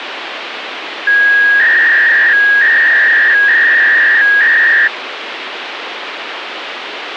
300-baud modem data (V.21 tones), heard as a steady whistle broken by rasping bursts, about 300 baud, 200 Hz shift, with phone line noise.